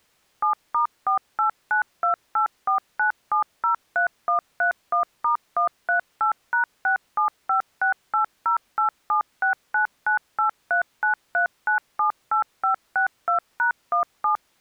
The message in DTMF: 7*4892849703131*138#675680876998393978562#17

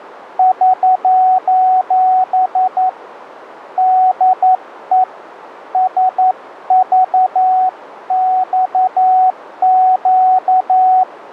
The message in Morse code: <SOS> DE SVXQ

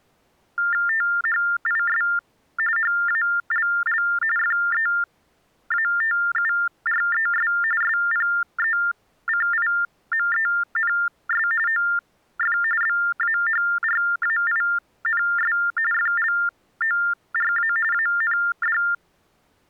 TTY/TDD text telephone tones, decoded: THIS HALL FEATURES SPECIMENS OF BAHRAINS FLORA AND

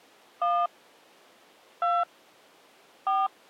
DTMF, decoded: 1 2 4

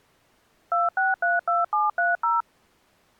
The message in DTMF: 2632730

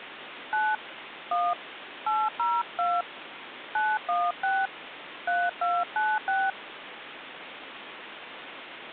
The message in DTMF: 9 1 802 916 3296

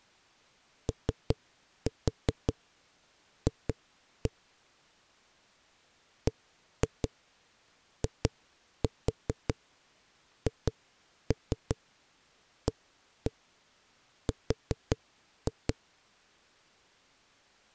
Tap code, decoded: OF BIHAR

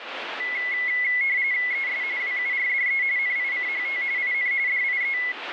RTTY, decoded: ES WURDE NICHT IN DIE

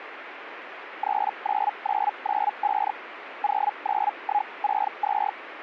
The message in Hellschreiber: 39995 09162

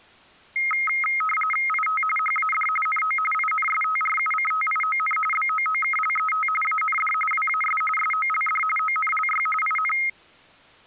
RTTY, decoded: IT HAD NO INSTRUCTION BOOKLET AND WAS SOLD ONLY IN

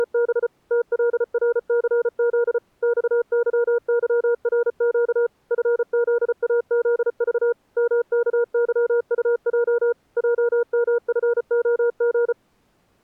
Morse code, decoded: … TLRCZ XYYRQ FZAZV MKYUJ JMFOG

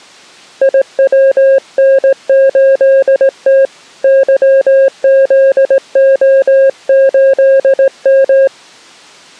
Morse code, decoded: IWN8T YZO8M

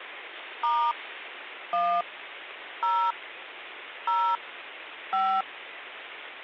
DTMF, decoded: * 1 0 0 5

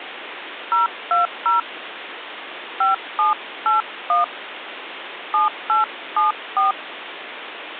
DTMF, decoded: 020 5781 7874

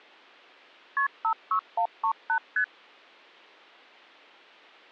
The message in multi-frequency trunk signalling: KP 56138 ST

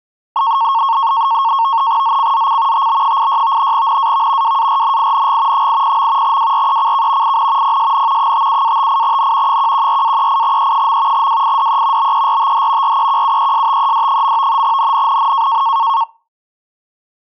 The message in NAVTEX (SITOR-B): ZCZC TB86 NAV WARNING 80. WRECK IN PSN 57-58N 114-38E. WIDE BERTH REQUESTED. NNNN

